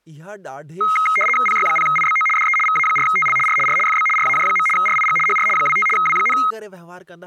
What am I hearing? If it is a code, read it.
RTTY (75 baud, 850 Hz shift), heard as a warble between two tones, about 1700 Hz centre, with speech in Sindhi. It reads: PY0IBO DE VA4TL R R FB RAJ. RIG HR 25 W,